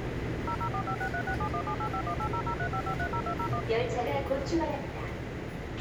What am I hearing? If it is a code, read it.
DTMF, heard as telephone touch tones, dialled by machine, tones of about 80 ms, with a squelch burst at the end and the noise inside a subway train. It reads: 004563671785180035530201